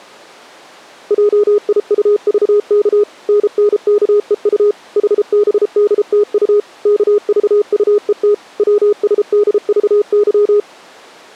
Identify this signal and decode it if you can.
Morse code, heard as a keyed tone, machine-sent, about 33 wpm, 410 Hz. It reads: JIUVK NNKEU HBDTU KVUET WSDVY